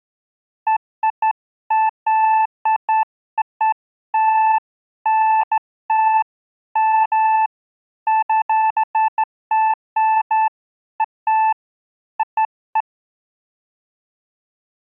Beeps of irregular length. There is no code.